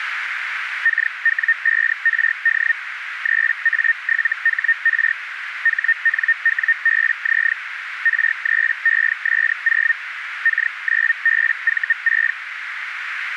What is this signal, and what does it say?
Hellschreiber (Feld-Hell, 122.5 baud), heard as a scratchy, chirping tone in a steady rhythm, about 1850 Hz, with radio static and a narrow filter. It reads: KW5RD 3A7HR HNWBZ R3ES0 K9BV6